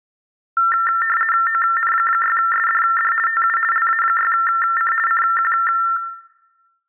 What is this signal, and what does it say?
RTTY (50 baud, 450 Hz shift), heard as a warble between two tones, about 1600 Hz centre. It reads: ON6SDD TU LA6C CQ